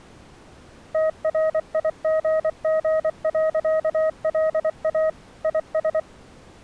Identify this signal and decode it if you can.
Morse code, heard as a keyed tone, machine-sent, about 24 wpm, 630 Hz. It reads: TRIGG.LA IS